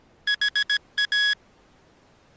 Morse code, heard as electronic beeps, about 17 wpm, 1650 Hz. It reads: HA